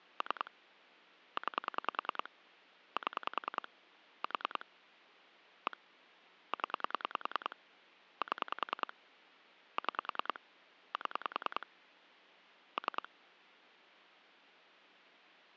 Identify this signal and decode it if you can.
Pulse dialling, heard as clicks on a phone line, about 10 pulses a second. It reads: 3 9 7 4 1 0 7 6 7 3